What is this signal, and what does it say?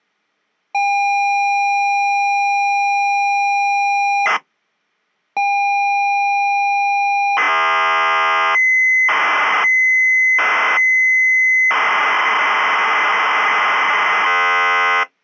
ZX Spectrum tape loading, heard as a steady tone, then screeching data.